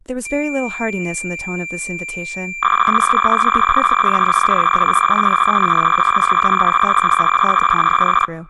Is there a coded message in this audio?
Yes: cassette data (Kansas City type), 300 baud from 0.3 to 8.3 s, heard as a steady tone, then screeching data, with speech in English.